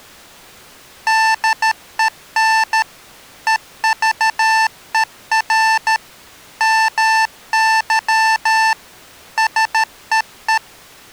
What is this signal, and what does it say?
Morse code, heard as electronic beeps, machine-sent, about 13 wpm, 890 Hz. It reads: DEN EVER MY SEE